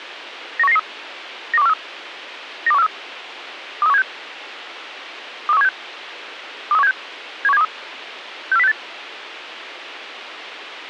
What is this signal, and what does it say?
Five-tone selective call (EEA), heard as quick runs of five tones, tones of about 40 ms, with radio hiss and a squelch burst at the end. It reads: 91993 92143 92143 23176 23176 23176 71723 64068